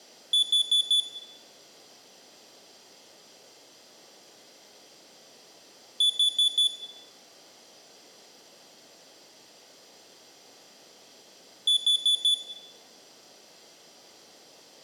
Alarm pattern, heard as an alarm's beeps, played three times, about 3450 Hz, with room echo. Temporal four. Carbon monoxide.